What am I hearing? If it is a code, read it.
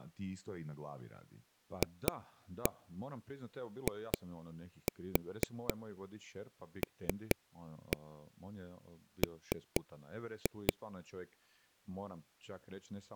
Tap code, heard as taps on a table, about 4 knocks a second, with speech in Croatian. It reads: FILM